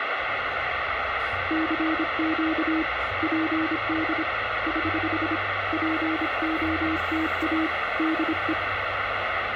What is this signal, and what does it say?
Morse code, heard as a keyed tone, hand-sent with a paddle, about 26 wpm, 320 Hz, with radio static and the noise inside a car. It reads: CQ PD <HH> POTA DE